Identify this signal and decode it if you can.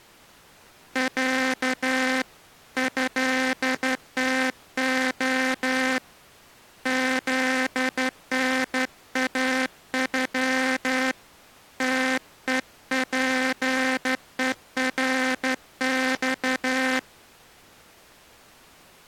Morse code (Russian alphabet), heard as a buzzer, hand-sent with a straight key, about 12 wpm. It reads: Я ЭТО ЗНАЮ ТЕПЕРЬ